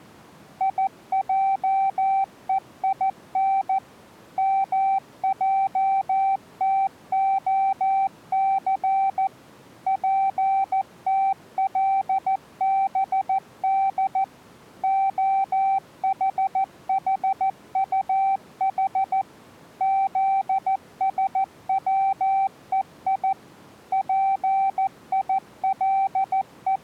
Morse code (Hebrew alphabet), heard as a keyed tone, machine-sent, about 14 wpm, 780 Hz. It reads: יעוין מעתהס פתלבד החחטח זשצוי …